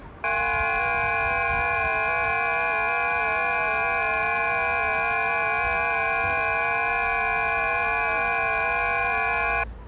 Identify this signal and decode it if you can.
FT8 (several signals at once), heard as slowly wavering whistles, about 6.25 baud, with the noise of a residential street.